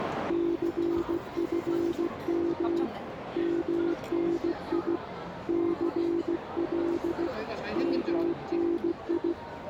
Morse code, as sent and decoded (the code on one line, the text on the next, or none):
-.-. ..-. -- / -- -. .. / -.-. .-.. / -- -. ..
CFM MNI CL MNI